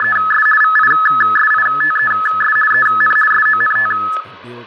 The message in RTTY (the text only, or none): … VISITES EN SONT